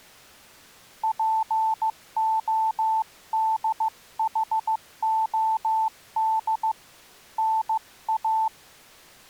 Morse code (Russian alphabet), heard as a keyed tone, hand-sent with a paddle, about 15 wpm, 880 Hz. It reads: ПОДХОД НА